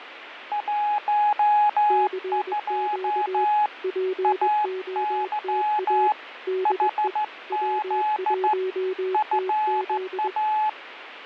Morse code, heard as two keyed tones, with radio static and fading. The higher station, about 14 wpm, 850 Hz: 12 AY HZ FA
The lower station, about 21 wpm, 370 Hz: CQ POTA DE W1TZ